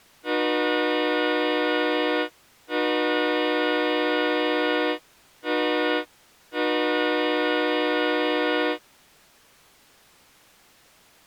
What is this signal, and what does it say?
Train horn signal, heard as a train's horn. 2 long, 1 short, 1 long. On North American railways: approaching a public crossing.